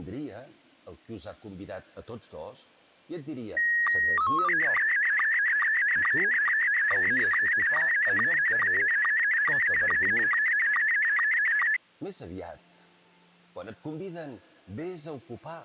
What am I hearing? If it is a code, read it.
SSTV (slow-scan television), Scottie S1, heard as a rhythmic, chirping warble.